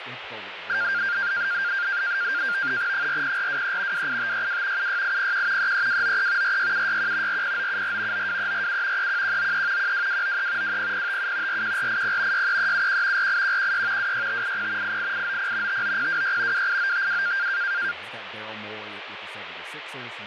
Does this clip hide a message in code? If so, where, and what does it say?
Yes: NAVTEX (SITOR-B), 100 baud, 170 Hz shift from 0.7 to 17.9 s, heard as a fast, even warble, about 1500 Hz centre, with radio static and speech in English. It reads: 40423 28562 76801 33293 46761 40974 92347 31193 12293 20057 41480 63371 48116 26580 88890 59026 28952